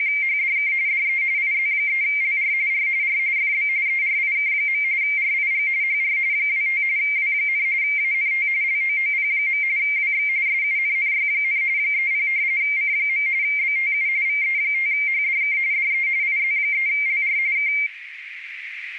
RTTY (45.45 baud, 170 Hz shift), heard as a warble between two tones, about 2200 Hz centre, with radio static and a narrow filter. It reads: … DE IZ3LR R R FB ERIK. RIG HR 25 W, ANT LOOP. WX SUNNY, 30 C. BTU VE5HDK DE IZ3LR K